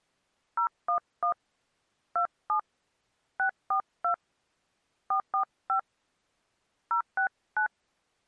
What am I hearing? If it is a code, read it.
DTMF, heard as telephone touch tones, dialled by hand, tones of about 100 ms. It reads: 011 27 642 445 069